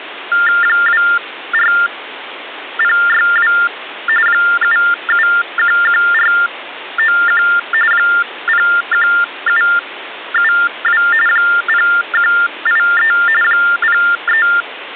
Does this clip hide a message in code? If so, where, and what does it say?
Yes: TTY/TDD text telephone tones (45.45 baud Baudot) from 0.3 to 14.6 s, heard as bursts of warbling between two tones, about 400 Hz shift, 1600 Hz centre, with phone line noise. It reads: 24062 7711491 01772 0183 03